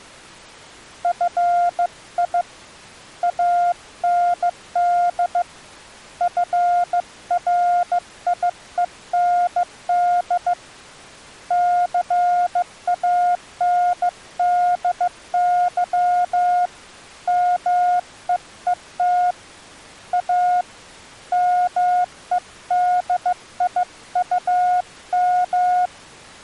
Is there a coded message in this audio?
Yes: Morse code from 1.0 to 25.9 s, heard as a keyed tone, hand-sent with a bug key, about 15 wpm, 710 Hz. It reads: FI AND FRIEND CANDY MEET A MEDIUM